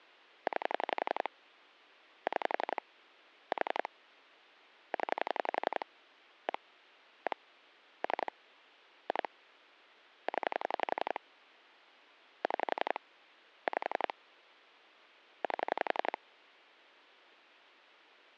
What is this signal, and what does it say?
Pulse dialling, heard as clicks on a phone line, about 11 pulses a second. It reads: 9 6 4 0 1 1 3 2 0 6 5 8